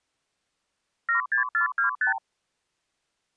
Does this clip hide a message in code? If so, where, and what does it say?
Yes: multi-frequency trunk signalling (R2, with the far end's replies) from 1.1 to 2.2 s, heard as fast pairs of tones, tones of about 120 ms. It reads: 76425